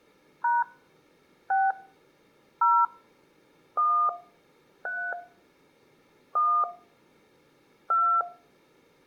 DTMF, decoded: # 6 0 1 3 1 2

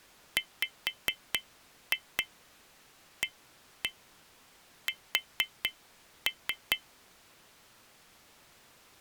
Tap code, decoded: WAS

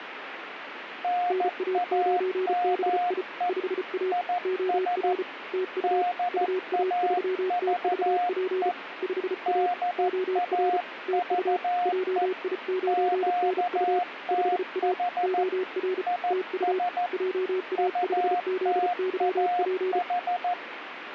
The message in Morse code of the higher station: NAME IS DAVE DAVE QTH IS UTAH

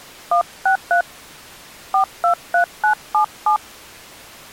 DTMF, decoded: 163 423977

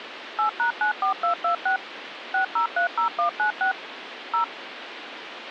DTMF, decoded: 8#94226 6030196 0

